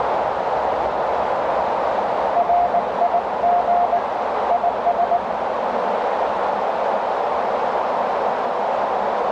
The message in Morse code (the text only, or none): RIG IS